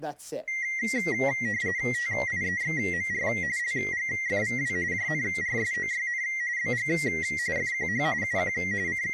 RTTY (45.45 baud, 170 Hz shift), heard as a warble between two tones, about 2000 Hz centre, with speech in English. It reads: TIEXMR LGFVW JNRSOYN BG FQH UQ …